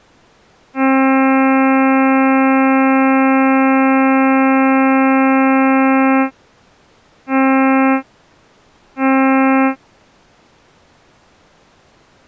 Ship horn signal, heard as a ship's horn, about 270 Hz. 1 long, 2 short. At sea: a vessel in fog that is sailing, fishing, towing or hampered.